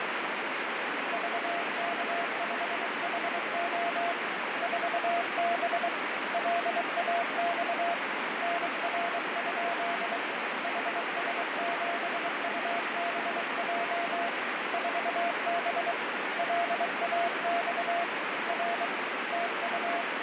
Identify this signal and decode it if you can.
Morse code, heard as a keyed tone, hand-sent with a bug key, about 23 wpm, 690 Hz, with heavy radio static. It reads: VK5HO 4B LAX NR? HS7UBJ 4B LAX R TU